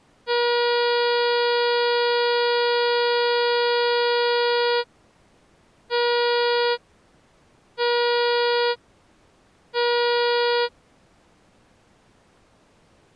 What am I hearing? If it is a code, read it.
Ship horn signal, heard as a ship's horn, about 480 Hz. 1 long, 3 short. At sea: a vessel under tow in fog.